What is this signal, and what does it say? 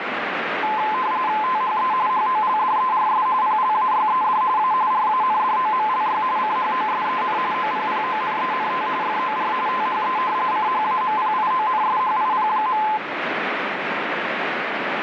RTTY (45.45 baud, 170 Hz shift), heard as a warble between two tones, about 950 Hz centre, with radio static. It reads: THE HOLDERS PLAYED A RANDOMLY CHOSEN OPPONENT FOR THE CHAMPIONSHIP.